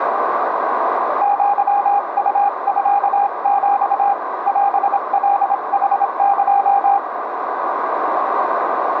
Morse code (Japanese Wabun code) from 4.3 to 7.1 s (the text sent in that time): オカヌエ